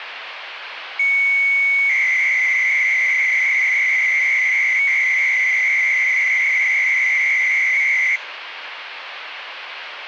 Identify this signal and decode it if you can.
300-baud modem data (Bell 103 tones), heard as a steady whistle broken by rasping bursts, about 300 baud, 200 Hz shift, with phone line noise.